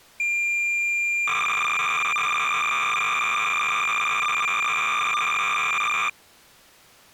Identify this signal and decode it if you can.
Cassette data (Kansas City type), 300 baud, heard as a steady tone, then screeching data.